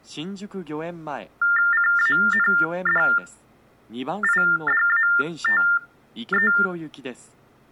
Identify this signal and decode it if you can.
TTY/TDD text telephone tones (45.45 baud Baudot), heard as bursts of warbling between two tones, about 400 Hz shift, 1600 Hz centre. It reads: CANDIDATE